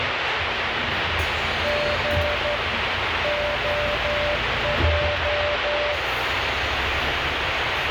Morse code, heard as a keyed tone, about 12 wpm, 590 Hz, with heavy radio static and the noise inside a bus. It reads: G OJ